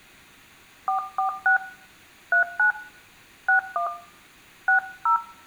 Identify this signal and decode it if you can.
DTMF, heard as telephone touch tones, dialled by hand, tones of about 110 ms, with room echo. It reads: 446 39 61 60